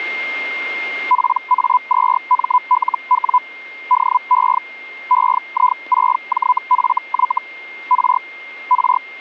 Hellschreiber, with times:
1.1-3.4 PA2MLW
3.9-4.6 DE
5.1-7.4 EI6JFY
7.9-8.2 R
8.7-9.0 R

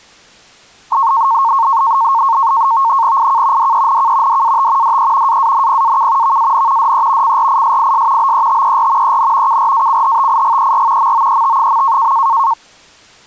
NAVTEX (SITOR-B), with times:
3.2-3.7 IK
3.6-4.4 DENK
4.3-5.0 DAT
4.8-5.4 DE
5.3-6.4 AANPAK
6.2-6.9 VAN
6.8-7.4 DE
7.2-8.3 CRISIS
8.2-9.2 BETER
9.0-9.6 EN
9.5-11.1 KRACHTIGER
11.0-12.1 MOET.

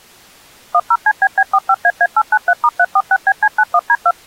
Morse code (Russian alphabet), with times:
none

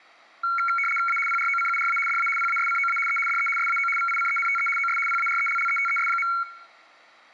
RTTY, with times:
1.1-1.2 A
1.3-2.0 PROCURA
2.1-2.3 DA
2.4-3.0 PASCOA
3.1-3.2 E
3.3-3.5 DE
3.6-3.9 SAO
4.0-4.7 VICENTE
4.8-5.0 OS
5.1-6.3 PARELLETES.

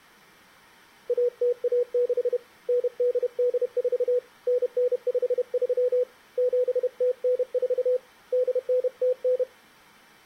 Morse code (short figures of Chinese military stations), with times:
1.1-2.4 1016
2.7-4.2 9884
4.5-6.0 9953
6.4-8.0 7094
8.3-9.4 8909

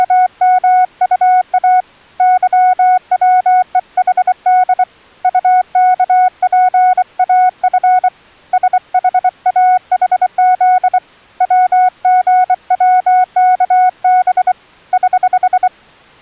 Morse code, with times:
0.0-1.8 …
2.2-4.8 YWEHD
5.2-8.1 UKPAF
8.5-11.0 SHAHZ
11.4-14.5 WGWKB
14.9-15.7 <HH>

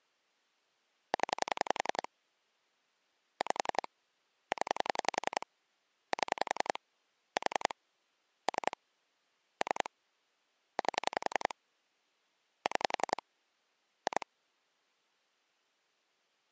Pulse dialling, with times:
1.1-2.1 0
3.4-3.9 5
4.5-5.5 0
6.1-6.8 7
7.4-7.7 4
8.5-8.8 3
9.6-9.9 3
10.8-11.5 8
12.7-13.2 6
14.1-14.3 2

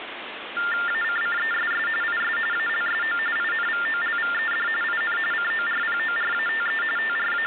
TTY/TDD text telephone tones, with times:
0.9-1.9 ACCESS
2.0-2.4 IS
2.5-3.2 ALSO
3.4-4.7 INVOLVED
4.8-5.2 IN
5.3-6.8 CORPORATE
7.0-7.5 …

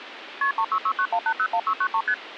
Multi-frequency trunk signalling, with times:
0.4-0.5 KP
0.6-2.0 36691801693
2.1-2.1 ST

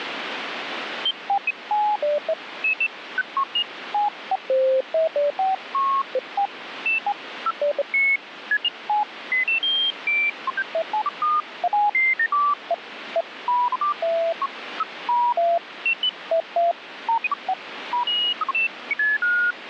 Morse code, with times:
none

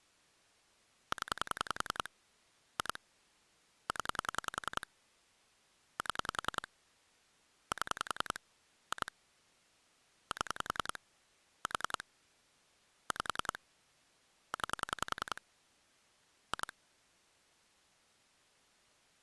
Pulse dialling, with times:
1.1-2.1 0
2.8-3.0 2
3.9-4.9 0
6.0-6.7 7
7.7-8.4 7
8.9-9.1 2
10.3-11.0 7
11.7-12.0 4
13.1-13.6 5
14.5-15.4 9
16.5-16.7 2

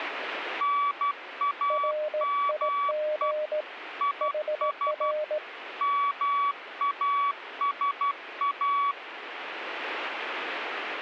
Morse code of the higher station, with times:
0.6-3.3 NAME
4.0-5.1 IS
5.8-8.9 MASA

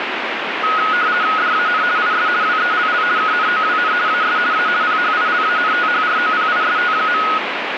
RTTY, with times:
1.4-1.8 DAN
2.0-2.3 IS
2.4-3.0 WELL
3.2-3.9 KNOWN
4.1-4.4 AS
4.5-4.7 A
4.8-7.2 PHILANTHROPIST.

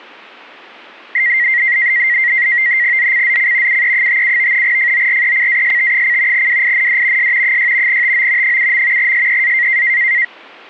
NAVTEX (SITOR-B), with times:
3.0-3.8 ZCZC
3.7-4.6 UE57
4.6-6.5 FORECAST:
6.3-7.3 WIND
7.2-7.6 S
7.4-8.0 6
7.9-8.6 TO
8.4-9.1 7.
9.0-9.8 SEA

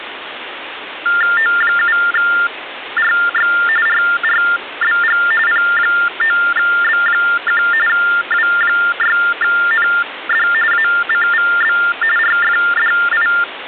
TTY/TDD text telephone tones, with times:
1.4-3.5 O7RX
3.9-5.2 RRBG
5.5-7.6 P9B1
7.9-10.5 W6ND
10.7-11.8 ACVB
12.2-13.3 RFDI

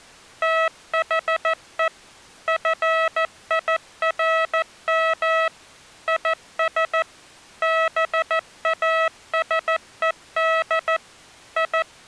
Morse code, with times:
0.4-1.9 THE
2.5-5.5 FIRM
6.1-7.0 IS
7.6-11.0 BASED
11.6-12.1 …

